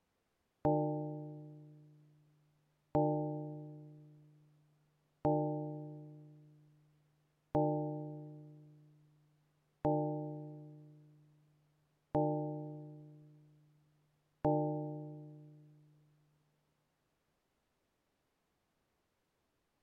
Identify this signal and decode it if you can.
Clock strike, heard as a bell. 7. Seven o'clock.